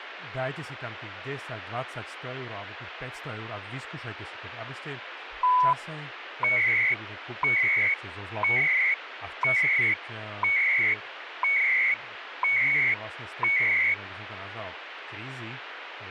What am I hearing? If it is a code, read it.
Radio time signal (CHU, Canada), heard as beeps and data bursts, one a second, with radio static and speech in Slovak.